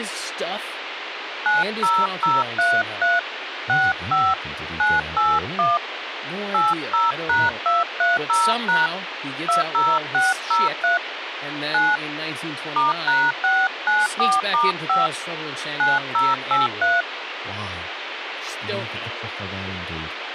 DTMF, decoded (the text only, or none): 90033 65 981 80#230# 20603 9 *#694*5 9083